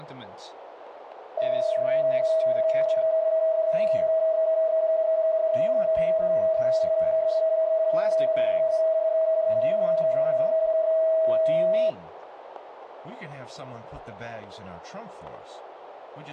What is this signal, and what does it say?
PSK31 (31.25 baud), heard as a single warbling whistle, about 640 Hz, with radio static.